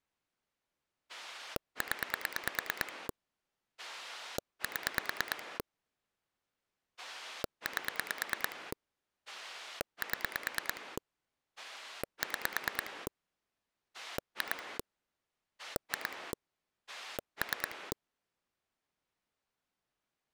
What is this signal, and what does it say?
Pulse dialling, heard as a rotary dial, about 9 pulses a second. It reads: 0 7 8 7 6 2 2 3